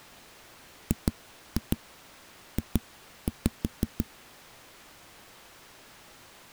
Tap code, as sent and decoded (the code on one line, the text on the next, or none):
2-2 2-5
GJ